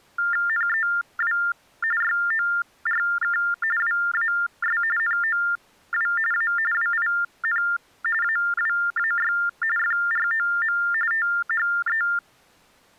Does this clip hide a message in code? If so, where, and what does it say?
Yes: TTY/TDD text telephone tones (45.45 baud Baudot) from 0.2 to 12.2 s, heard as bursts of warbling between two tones, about 400 Hz shift, 1600 Hz centre. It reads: NEW YORK WAS NOW A WIN AWAY FROM THE